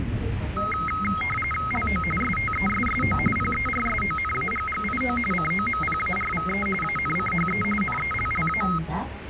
RTTY (45.45 baud, 850 Hz shift), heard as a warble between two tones, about 1700 Hz centre, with radio static and the noise inside a bus. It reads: LO STESSO PERSONAGGIO COMPARVE ANCHE NELLA